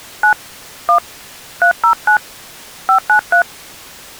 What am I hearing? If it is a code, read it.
DTMF, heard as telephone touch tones, dialled by hand, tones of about 100 ms. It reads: 9 1 309 593